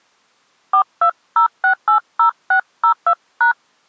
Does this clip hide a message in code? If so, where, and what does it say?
Yes: DTMF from 0.7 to 3.5 s, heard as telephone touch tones, dialled by hand, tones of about 100 ms. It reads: 420680602#